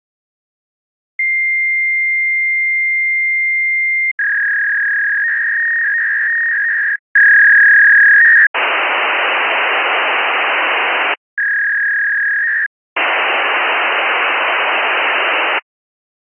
Fax machine handshake, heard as a long tone, a warble and hiss.